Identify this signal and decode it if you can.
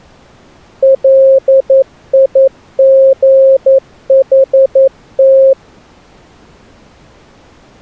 Morse code, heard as a keyed tone, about 11 wpm, 540 Hz. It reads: LIGHT